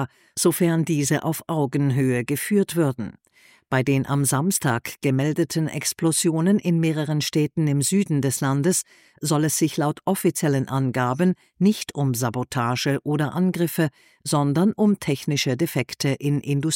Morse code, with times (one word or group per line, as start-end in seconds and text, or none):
none